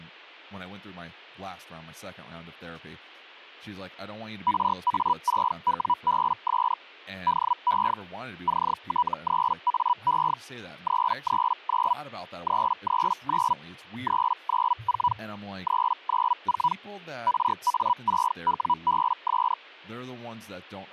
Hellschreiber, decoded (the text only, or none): RA6WBS DE CT3AE 339 339 394 394 RA6WBS